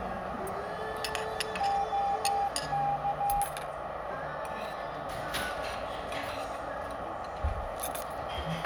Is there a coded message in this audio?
Yes: Morse code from 1.5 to 3.5 s, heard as a keyed tone, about 15 wpm, 800 Hz, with radio static, a narrow filter and the noise of a restaurant. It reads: OK